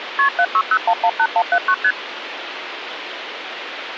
Multi-frequency trunk signalling (R1, as on North American trunks), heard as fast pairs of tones, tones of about 60 ms, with phone line noise. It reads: KP 760118179 ST